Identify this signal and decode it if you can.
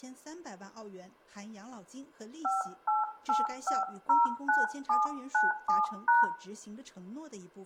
DTMF, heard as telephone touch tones, dialled by hand, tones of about 160 ms, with room echo. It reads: 588509797#